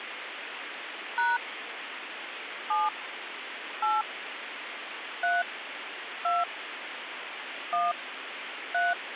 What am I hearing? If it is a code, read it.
DTMF, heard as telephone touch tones, dialled by hand, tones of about 190 ms, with phone line noise. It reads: # 7 8 3 2 1 3